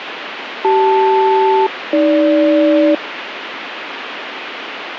Aircraft SELCAL, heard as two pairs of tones, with radio static. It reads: CL-AG